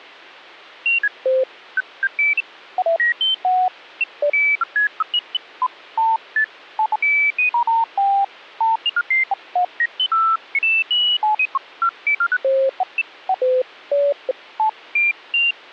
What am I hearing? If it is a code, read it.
Electronic bleeps of random pitch and length. There is no code.